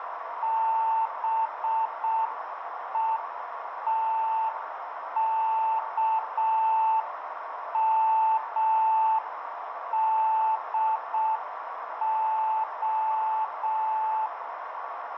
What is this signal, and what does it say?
Morse code (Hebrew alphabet), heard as a keyed tone, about 6 wpm, 880 Hz, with radio static and a narrow filter. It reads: בותכמדה